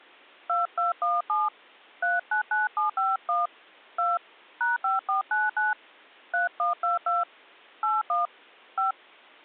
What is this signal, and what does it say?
DTMF, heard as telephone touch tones, dialled by hand, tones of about 150 ms. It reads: 2217 399751 2 #5499 3122 81 5